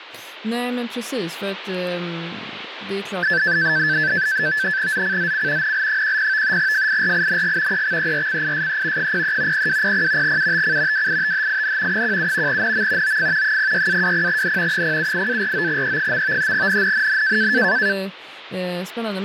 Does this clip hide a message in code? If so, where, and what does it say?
Yes: NAVTEX (SITOR-B), 100 baud, 170 Hz shift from 3.2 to 17.9 s, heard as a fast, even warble, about 1650 Hz centre, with radio static and speech in Swedish. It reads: ZCZC NL10 FIRING EXERCISE 03 0200 UTC WITHIN 17 NM OF 06-20N 078-49E. NNNN